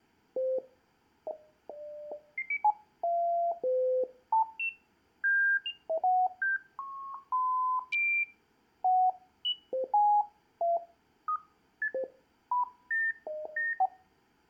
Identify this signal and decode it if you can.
Electronic bleeps of random pitch and length, with room echo. There is no code.